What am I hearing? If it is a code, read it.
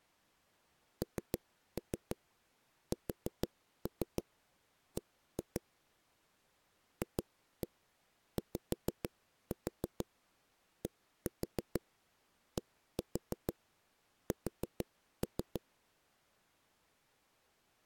Tap code, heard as knocks on a wall, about 6 knocks a second. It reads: NSB FYDDS